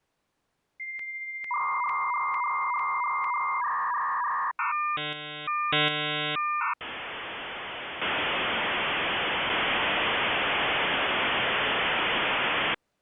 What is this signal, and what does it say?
Dial-up modem handshake (V.34 or later), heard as a whistle, warbles, then hiss.